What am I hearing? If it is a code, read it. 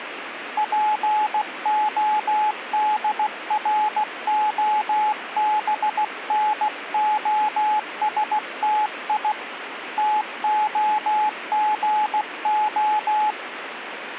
Morse code (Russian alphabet), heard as a keyed tone, hand-sent with a paddle, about 16 wpm, 850 Hz, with radio static. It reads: ПОДРОБНОСТИ ТОГО